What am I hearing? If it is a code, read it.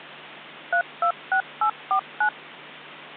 DTMF, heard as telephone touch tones, dialled by machine, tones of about 90 ms, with hum. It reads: 326849